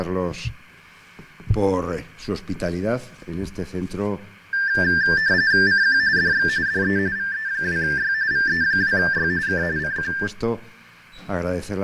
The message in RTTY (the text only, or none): CQ DX DE VE2Y VE2Y K CQ